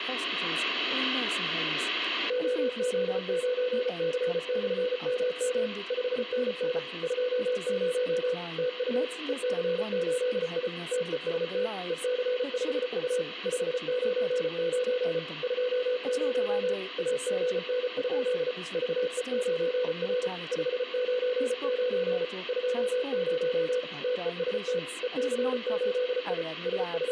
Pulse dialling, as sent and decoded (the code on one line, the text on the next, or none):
none